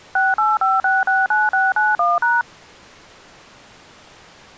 DTMF, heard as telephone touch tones, dialled by machine, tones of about 190 ms. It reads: 685669691#